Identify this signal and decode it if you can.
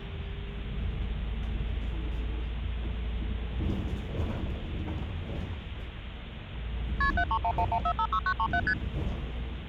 Multi-frequency trunk signalling (R1, as on North American trunks), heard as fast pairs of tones, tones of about 70 ms, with the noise inside a bus. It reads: KP 73111456937 ST